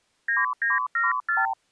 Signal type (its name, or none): multi-frequency trunk signalling